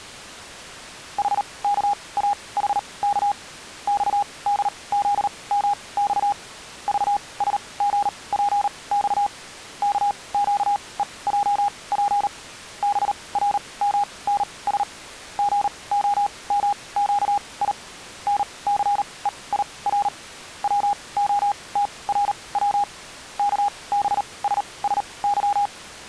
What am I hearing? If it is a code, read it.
Morse code, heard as a keyed tone, machine-sent, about 38 wpm, spaced as for 24 wpm, 820 Hz. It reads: HKAHK XDZMX VSGPX KQEJP BRMNS GOMQI NCEIR WOTRW KBSSY